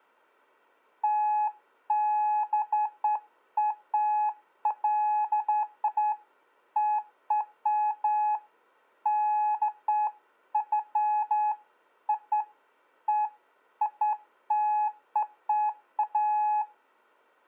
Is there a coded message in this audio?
No, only beeps of irregular length.